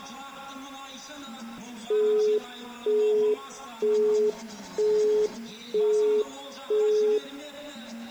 Telephone call progress tone (single-tone plan, as in Europe, Japan and elsewhere), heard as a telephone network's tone, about 420 Hz, 0.48 s on and 0.48 s off. Busy tone.